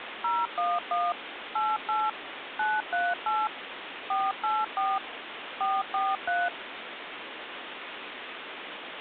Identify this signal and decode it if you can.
DTMF, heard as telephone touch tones, dialled by machine, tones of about 210 ms, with phone line noise. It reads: 011 88 938 484 443